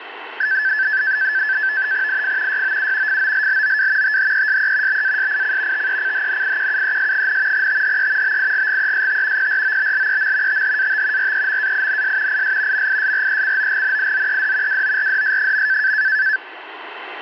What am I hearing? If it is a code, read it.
NAVTEX (SITOR-B), 100 baud, 170 Hz shift, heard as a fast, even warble, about 1650 Hz centre, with radio static. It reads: IF YOU FOLLOW THESE BASIC TECHNIQUES, THE BIGGEST PROBLEM THAT REMAINS IS MISRECOGNIZED WORDS.